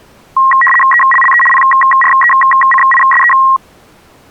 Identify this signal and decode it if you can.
RTTY (75 baud, 850 Hz shift), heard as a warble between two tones, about 1490 Hz centre. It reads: ELLE PRECISE